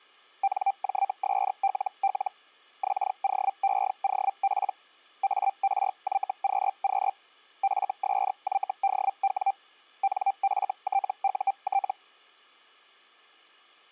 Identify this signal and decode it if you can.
Hellschreiber (Feld-Hell, 122.5 baud), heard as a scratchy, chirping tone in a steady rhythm, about 790 Hz. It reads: NJSLL XOEOP ARYQQ FSYDW NFTUT